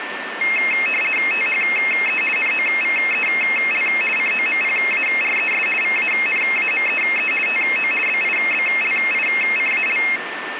RTTY (50 baud, 450 Hz shift), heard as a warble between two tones, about 2350 Hz centre, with radio static and a steady whistle near 1790 Hz. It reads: THE NOVEL COMPARES VANAMEE TO BIBLICAL